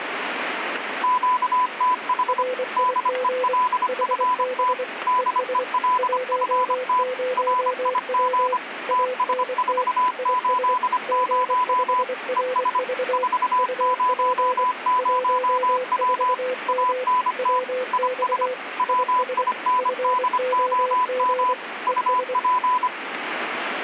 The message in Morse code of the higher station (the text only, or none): QTH DELFT DELFT RIG TS480 ES 400W ANT IS WINDOM UP